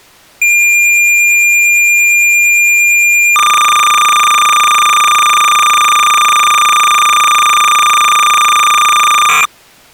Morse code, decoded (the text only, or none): none